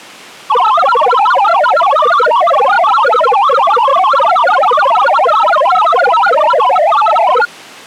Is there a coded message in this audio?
Yes: multi-tone FSK (Olivia or MFSK type), about 1000 Hz wide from 0.5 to 7.5 s, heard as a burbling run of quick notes, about 62.5 baud.